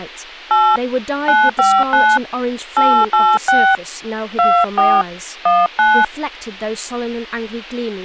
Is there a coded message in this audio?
Yes: DTMF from 0.5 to 6.0 s, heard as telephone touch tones, dialled by hand, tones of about 210 ms, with speech in English. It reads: 8 959 886 24 19